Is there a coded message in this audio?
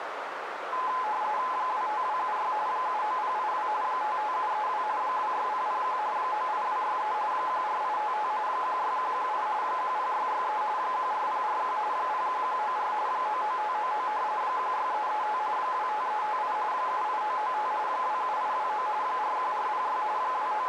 Yes: RTTY (45.45 baud, 170 Hz shift) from 0.7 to 20.7 s, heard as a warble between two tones, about 940 Hz centre, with radio static and a narrow filter. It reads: 25276 79082 55732 26001 98263 14855 16118 10663 14041 01194 99599 16335 25358 78995 27829 41406 …